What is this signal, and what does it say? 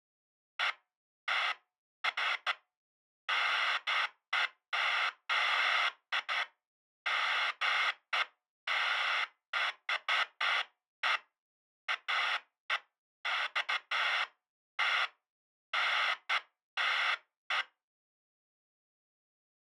Bursts of noise. There is no code.